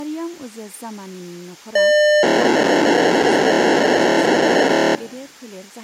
POCSAG pager data (1200 baud), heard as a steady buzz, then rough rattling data, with speech in Bodo.